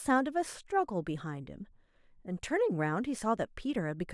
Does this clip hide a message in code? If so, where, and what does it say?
No, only speech in English.